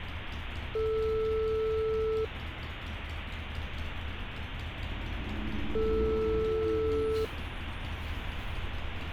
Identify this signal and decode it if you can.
Telephone call progress tone (single-tone plan, as in most of Europe), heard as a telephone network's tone, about 440 Hz, 1.5 s on and 3.5 s off, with street noise. Ringback tone.